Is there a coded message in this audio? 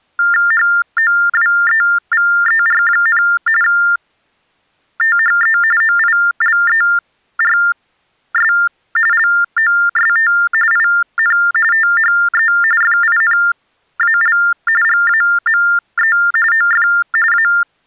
Yes: TTY/TDD text telephone tones (45.45 baud Baudot) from 0.2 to 17.6 s, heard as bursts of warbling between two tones, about 400 Hz shift, 1600 Hz centre. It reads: HOWEVER, THE OILERS LOST IN THE FINAL GAME OF A